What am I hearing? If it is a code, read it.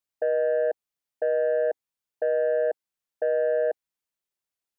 Telephone call progress tone (North American plan), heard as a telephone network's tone, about 480, 620 Hz, 0.5 s on and 0.5 s off. Busy tone.